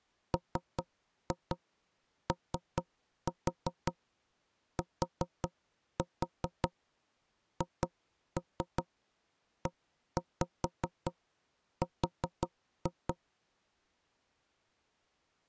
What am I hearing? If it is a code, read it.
Tap code, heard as knocks on wood, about 5 knocks a second. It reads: MOTHER